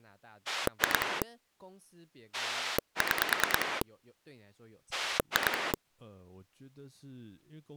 Pulse dialling, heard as a rotary dial, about 9 pulses a second, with speech in Chinese. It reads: 2 6 2